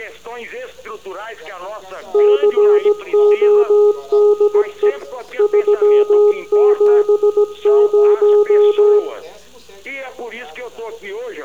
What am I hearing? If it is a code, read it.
Morse code, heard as a keyed tone, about 17 wpm, 420 Hz, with room echo. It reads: CODE 370